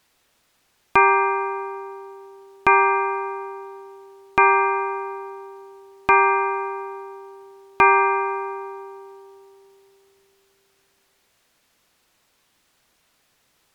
Clock strike, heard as a bell. 5. Five o'clock.